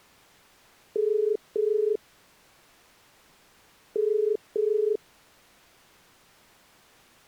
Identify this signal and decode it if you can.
Telephone call progress tone (as in the UK, Ireland, Australia and similar networks), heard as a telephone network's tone, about 430 Hz. Ringback tone.